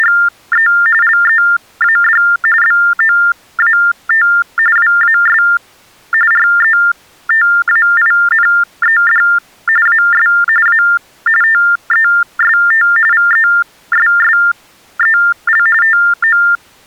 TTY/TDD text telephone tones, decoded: … LEAD BOAT WAS RETAINED AS A TEST VESSEL TO

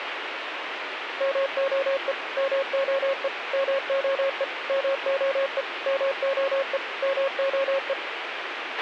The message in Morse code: MOE MOE MOE MOE MOE MOE

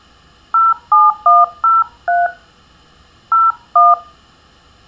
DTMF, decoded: 07103 01

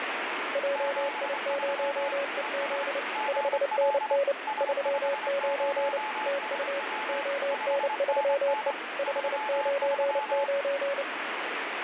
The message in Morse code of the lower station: JI0EZ 5NN 39 TU ON3E 599

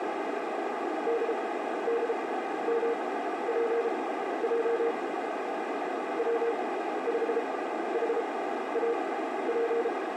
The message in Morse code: DDMPJ W5HAP

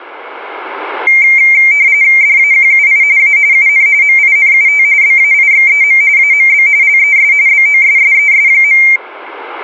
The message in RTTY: DAQUI A UN MINUT BAIXEM AMB LES BOSSES.

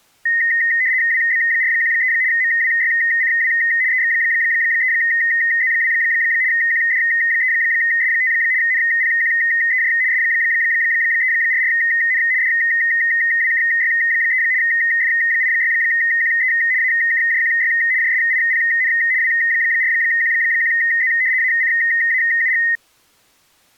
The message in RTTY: WB413 MWYCW EX3Z2 QD3S5 NPQEJ S344N DWKY3 F86QE AKJQY JSIPN W4Q1Z ACAUG

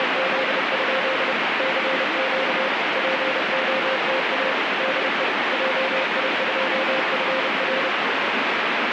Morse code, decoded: … CQ POTA DE JI2FR

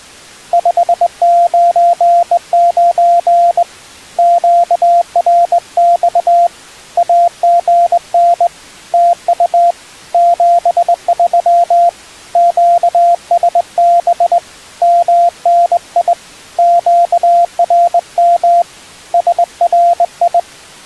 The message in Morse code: 599 QRX AGN TU 73 QSB MNI QRM SRI

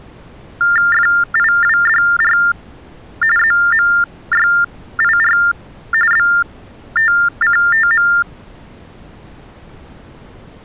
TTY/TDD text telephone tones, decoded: FIWDR ZMYIR BTCTM

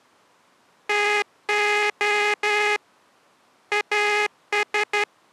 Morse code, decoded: TO AS

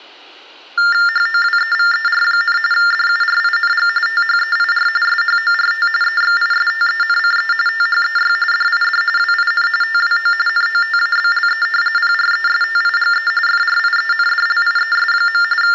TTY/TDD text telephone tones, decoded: HOWEVER, DURING THEIR SHORT EXISTENCE THEY DID WIN TWO NOTABLE PRESTIGE FRIENDLIES. …

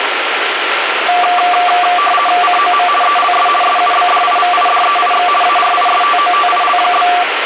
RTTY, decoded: COM ELS SUBDIVIDEIX ARISTOTIL?

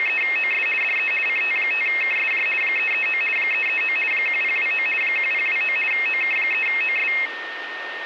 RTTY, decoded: … DE CT5KSJ 339 339 1029 1029 OK3OS

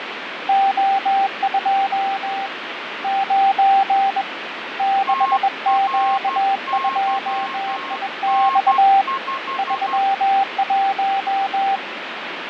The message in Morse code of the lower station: O2 9 6Q2IX 31

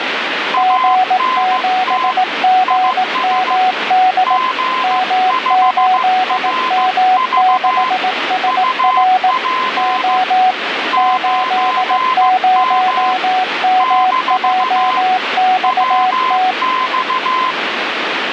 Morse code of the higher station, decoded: ANT IS G5RV UP 9M - WX

